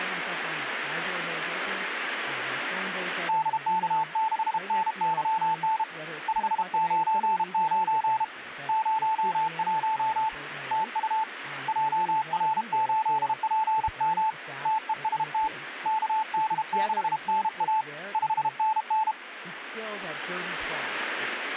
Morse code, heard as a keyed tone, hand-sent with a paddle, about 32 wpm, 880 Hz, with radio static and speech in English. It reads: DK6NYN 599 01 TU JR8PM TEST KD6NA 5NN